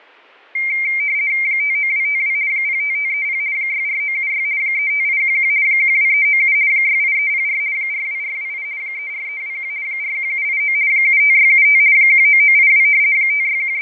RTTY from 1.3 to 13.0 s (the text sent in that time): 59252 05530 64976 35811 12397 68304 42428 34321 41789 75675 19982